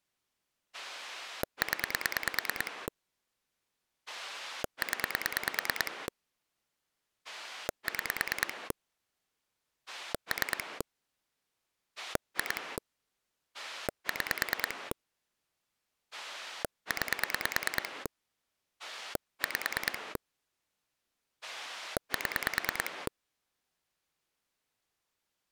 Pulse dialling, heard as a rotary dial, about 9 pulses a second. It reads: 0 0 6 3 2 6 9 5 7